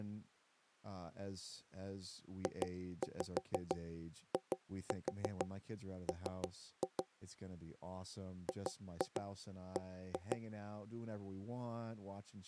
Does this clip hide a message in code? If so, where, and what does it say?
Yes: tap code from 2.5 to 10.4 s, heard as knocks on wood, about 6 knocks a second, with speech in English. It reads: JIM GB